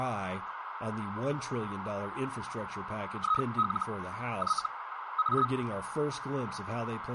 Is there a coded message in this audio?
Yes: Hellschreiber (Feld-Hell, 122.5 baud) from 3.2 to 5.5 s, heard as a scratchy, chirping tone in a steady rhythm, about 1270 Hz, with radio static, a narrow filter and speech in English. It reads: IL Y A